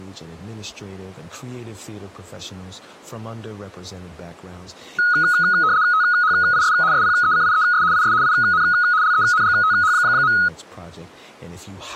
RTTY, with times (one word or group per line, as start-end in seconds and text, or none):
5.9-6.7 THIS
6.9-7.8 SPECIES
7.9-8.1 IS
8.2-8.6 IN
9.0-10.3 LENGTH.